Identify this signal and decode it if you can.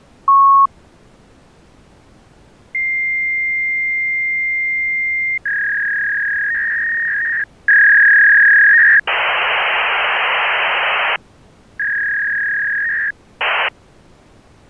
Fax machine handshake, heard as a long tone, a warble and hiss.